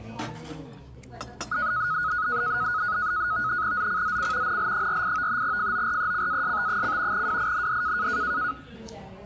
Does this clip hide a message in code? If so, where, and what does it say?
Yes: NAVTEX (SITOR-B), 100 baud, 170 Hz shift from 1.5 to 8.5 s, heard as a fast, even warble, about 1360 Hz centre, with the noise of a restaurant. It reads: ZCZC NL48 FORECAST: WIND